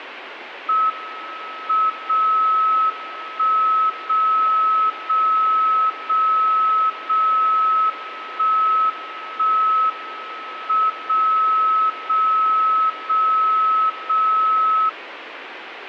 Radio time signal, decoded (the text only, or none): M 0 1 0 0 0 0 1 1 M 0 0 0 0